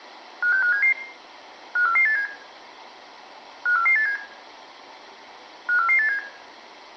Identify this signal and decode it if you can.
Five-tone selective call (CCIR), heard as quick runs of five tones, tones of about 100 ms, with room echo. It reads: 56577 54487 54487 54487